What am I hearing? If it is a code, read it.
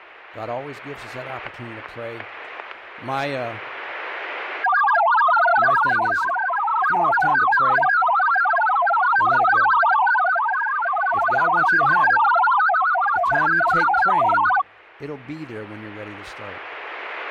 Multi-tone FSK (Olivia or MFSK type), about 1000 Hz wide, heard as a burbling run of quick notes, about 62.5 baud, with static crashes.